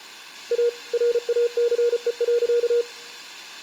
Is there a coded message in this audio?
Yes: Morse code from 0.5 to 2.9 s, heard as a keyed tone, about 34 wpm, 480 Hz. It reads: A RACE.